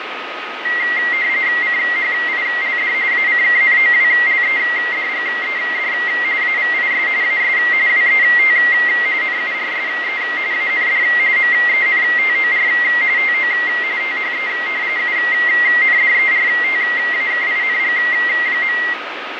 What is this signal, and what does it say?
RTTY (45.45 baud, 170 Hz shift), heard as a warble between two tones, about 2000 Hz centre, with radio static, fading and a steady whistle near 1260 Hz. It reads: CHILD ACKNOWLEDGED AVIS AS WET NURSE AND MENTOR TO THE UNDERTAKING.